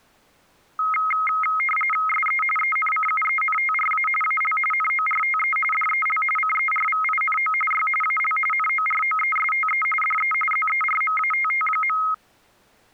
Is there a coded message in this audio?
Yes: RTTY (45.45 baud, 850 Hz shift) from 0.8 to 12.1 s, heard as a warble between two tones, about 1700 Hz centre. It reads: SE ENCUENTRA AL NORTE DEL CERVINO Y AL NOROESTE DE ZERMATT.